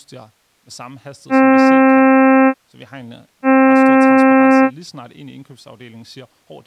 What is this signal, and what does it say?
Ship horn signal, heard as a ship's horn, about 260 Hz, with speech in Danish. 2 short. At sea: I am altering course to port.